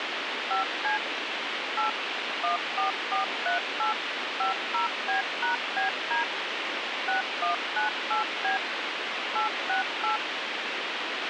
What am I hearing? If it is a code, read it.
DTMF, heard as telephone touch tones, dialled by machine, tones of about 130 ms, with radio hiss and a squelch burst at the end. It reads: 5C 8 14438 50B#BD 6198B 868